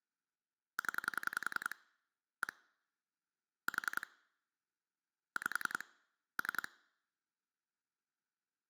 Pulse dialling, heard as clicks on a phone line, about 10 pulses a second. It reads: 0 1 4 5 3